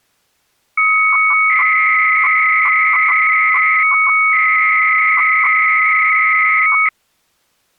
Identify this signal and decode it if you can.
300-baud modem data (Bell 103 tones), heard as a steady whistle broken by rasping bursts, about 300 baud, 200 Hz shift.